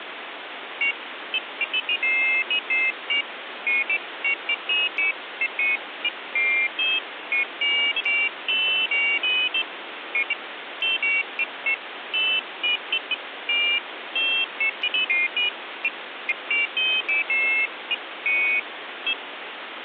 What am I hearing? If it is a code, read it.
Pairs of high tones at irregular times, with phone line noise. There is no code.